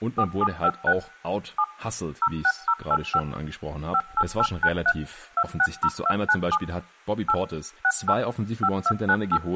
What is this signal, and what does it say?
DTMF, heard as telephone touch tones, dialled by machine, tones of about 60 ms, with speech in German. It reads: 4756 7 06085 58893 260297 8 68 5298